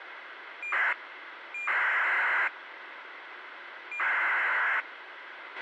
ACARS aircraft data, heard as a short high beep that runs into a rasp, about 2400 baud, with radio hiss and a squelch burst at the end.